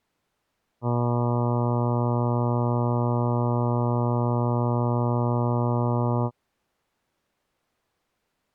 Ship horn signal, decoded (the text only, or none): 1 long